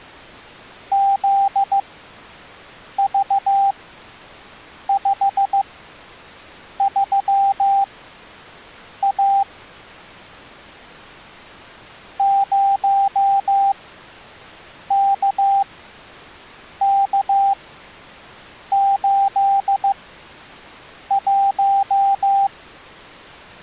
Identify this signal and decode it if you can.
Morse code, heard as a keyed tone, machine-sent, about 15 wpm, spaced as for 6 wpm, 790 Hz. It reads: ZV53A 0KK81